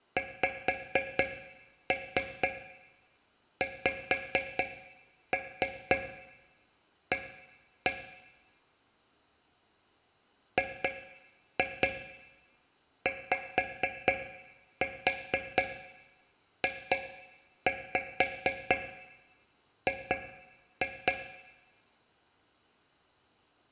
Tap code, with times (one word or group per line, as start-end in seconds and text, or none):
0.2-7.9 XXA
10.6-21.1 GYJG